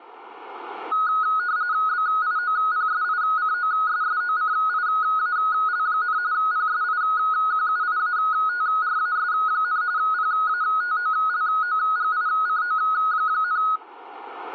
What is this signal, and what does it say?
RTTY (45.45 baud, 170 Hz shift), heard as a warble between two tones, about 1360 Hz centre. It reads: BIOPSICOSSOCIAL, PSIQUIATRAS, PATOLOGICO,